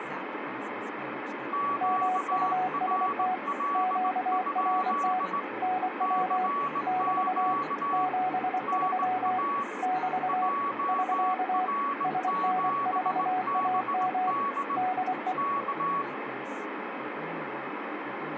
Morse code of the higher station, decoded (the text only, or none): QRL? CQ NA JR7BD K